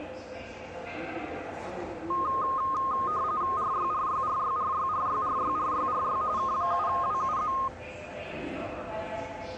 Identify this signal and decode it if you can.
RTTY (45.45 baud, 170 Hz shift), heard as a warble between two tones, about 1150 Hz centre, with the noise of a subway station. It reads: RYRYRYRYRYRYRYRY K7WUZ